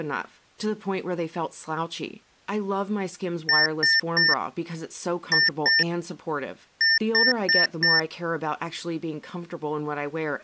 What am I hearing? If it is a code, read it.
Beep code, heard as beeps from a small speaker, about 1800 Hz, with speech in English. 3-2-4. In Phoenix BIOS tables: keyboard controller failure.